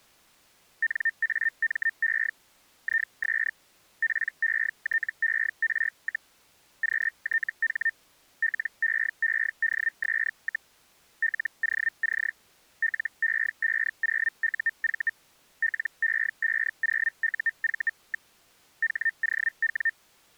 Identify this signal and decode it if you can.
Hellschreiber (Feld-Hell, 122.5 baud), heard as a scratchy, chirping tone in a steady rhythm, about 1800 Hz. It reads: NAME IS PETER, QTH LEEDS, LOC LE50UV LE50UV. HOW